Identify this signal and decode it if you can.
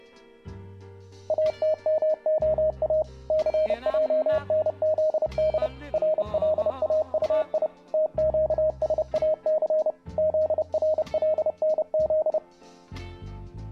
Morse code (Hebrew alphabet), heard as a keyed tone, machine-sent, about 30 wpm, 620 Hz. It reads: אתמהא סענזד רלאטי תקשאס זרלנז